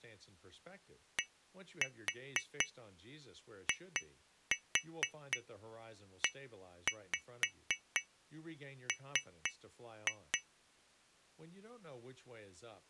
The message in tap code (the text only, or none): DIEM